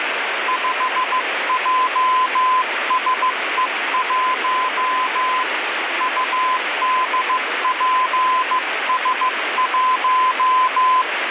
Morse code, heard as a keyed tone, hand-sent with a bug key, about 15 wpm, 1020 Hz, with radio static. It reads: 5JSE1 UDPS1